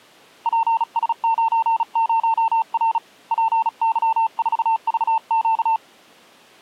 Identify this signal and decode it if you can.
Morse code, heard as a keyed tone, hand-sent with a paddle, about 36 wpm, 900 Hz. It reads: PS90R PY4VQ